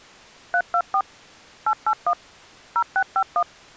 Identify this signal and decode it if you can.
DTMF, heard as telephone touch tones, dialled by machine, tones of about 70 ms. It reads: 324 881 0651